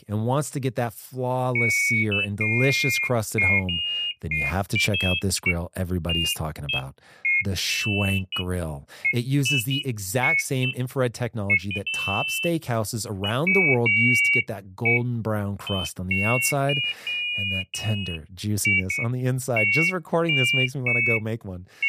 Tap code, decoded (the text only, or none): none